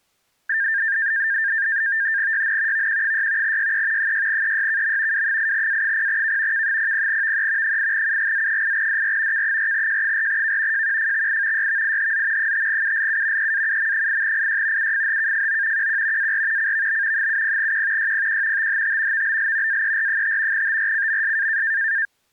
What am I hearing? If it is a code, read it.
NAVTEX (SITOR-B), 100 baud, 170 Hz shift, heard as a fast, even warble, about 1700 Hz centre. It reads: YN VQ6 YE 6EYKM W8A0K K00VE 8UGZ8DR K4J4K JQFXI YVIHZ 5ULU EAUM8IY UFHKFO QQ AR CVB 70Q YPQ THT VBL AER5 TRCMS